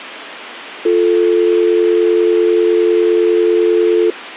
Telephone call progress tone (North American or UK plan), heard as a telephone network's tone, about 350, 440 Hz. Dial tone.